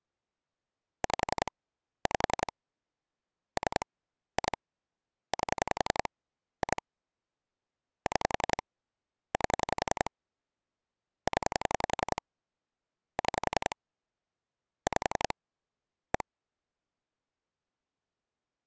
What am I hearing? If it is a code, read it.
Pulse dialling, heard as clicks on a phone line, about 11 pulses a second. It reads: 5 5 3 2 8 2 6 8 0 6 5 1